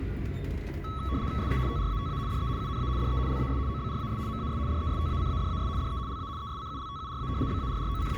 RTTY (75 baud, 170 Hz shift), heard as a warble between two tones, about 1210 Hz centre, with static crashes and the noise inside a bus. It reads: SE TRATA DE UNA DE LAS OBRAS MAS DESTACADAS DE LA ESCULTURA …